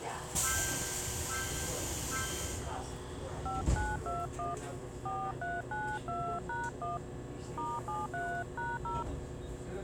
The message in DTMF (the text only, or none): 5921 4392#1 *73#0